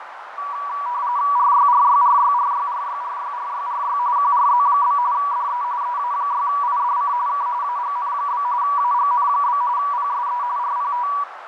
RTTY (45.45 baud, 170 Hz shift), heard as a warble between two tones, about 1060 Hz centre, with radio static, fading and a narrow filter. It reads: RYRYRYRYRYRYRYRY QRZ? DE EA6IDC K AGN? AGN? PSE RPT